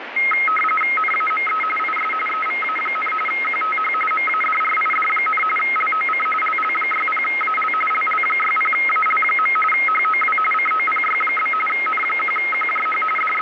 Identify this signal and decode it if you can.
RTTY (45.45 baud, 850 Hz shift), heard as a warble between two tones, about 1700 Hz centre, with radio static. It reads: NAME IS EVA, QTH MADRID, LOC LL60AL LL60AL. HOW COPY? N1QJH …